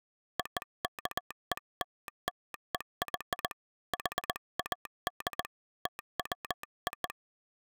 Morse code (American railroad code), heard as a telegraph sounder, hand-sent with a straight key. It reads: OKELLEY HAD TWO